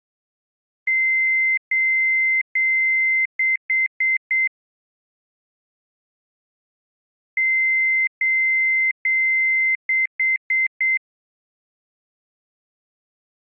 Beep code, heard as beeps, played twice, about 2100 Hz. 3 long, 4 short.